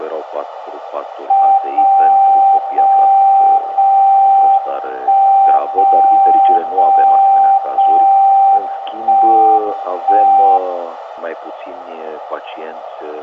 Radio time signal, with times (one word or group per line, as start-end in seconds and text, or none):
1.6-2.6 0
2.6-3.6 0
3.6-4.6 0
4.6-5.6 1
5.6-6.6 0
6.6-7.6 0
7.6-8.6 0
8.6-9.6 1
9.6-10.6 1